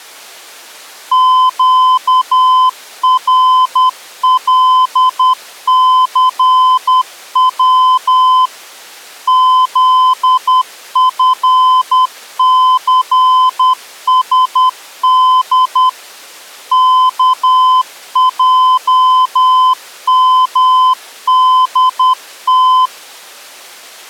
Morse code, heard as a keyed tone, machine-sent, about 10 wpm, 1020 Hz. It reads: QRLCW ZFCSD KJMDT